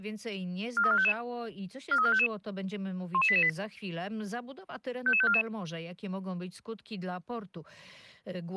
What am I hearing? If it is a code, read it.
Five-tone selective call (ZVEI), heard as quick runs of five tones, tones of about 70 ms. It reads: 43455 43455 11888 55544